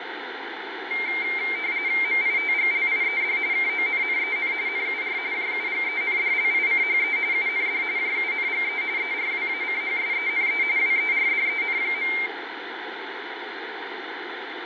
RTTY (45.45 baud, 170 Hz shift), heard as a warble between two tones, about 2200 Hz centre, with radio static and room echo. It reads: MITGLIED KONNEN NUR JUGENDLICHE UND JUNGE ERWACHSENE WERDEN.